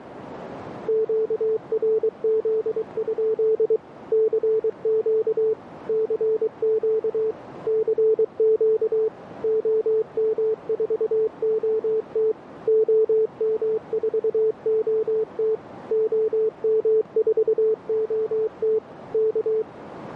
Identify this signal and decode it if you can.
Morse code, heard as a keyed tone, machine-sent, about 23 wpm, 440 Hz, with radio static and a narrow filter. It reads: QRZ? CQ CQ CQ OM4OT OM4OT OM4OT K